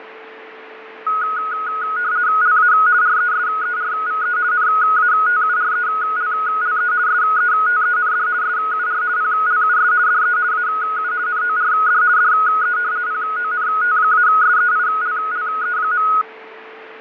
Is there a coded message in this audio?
Yes: RTTY (50 baud, 170 Hz shift) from 1.1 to 16.2 s, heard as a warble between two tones, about 1360 Hz centre, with radio static, fading and a steady whistle near 440 Hz. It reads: LA RESERVE NATURELLE SETEND SUR PLUS DE AU NORD DE PONT-SEILLE.